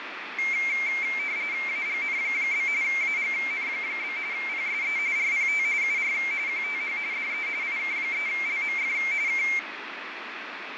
RTTY (45.45 baud, 170 Hz shift), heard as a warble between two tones, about 2200 Hz centre, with radio static and fading. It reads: AGN? AGN? PSE RPT UR QTH DE IK3LMF K